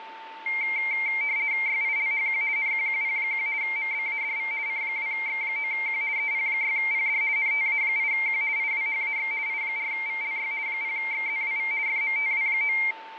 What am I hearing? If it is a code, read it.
RTTY (50 baud, 170 Hz shift), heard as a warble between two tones, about 2200 Hz centre, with radio static and a steady whistle near 890 Hz. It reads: YILHQ NQQP1 MBADV C2X9Q EP6PD NTA8Q IWHAX I4VLY 0XZWV FMTW9